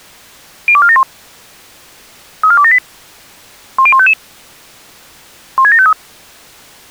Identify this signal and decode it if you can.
Five-tone selective call (ZVEI), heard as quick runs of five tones, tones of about 70 ms. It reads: 02471 34278 10155 16753